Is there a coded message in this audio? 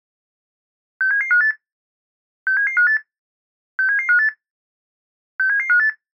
Yes: five-tone selective call (CCIR) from 1.0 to 5.9 s, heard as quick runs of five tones, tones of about 100 ms. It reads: 67758 67758 67758 67758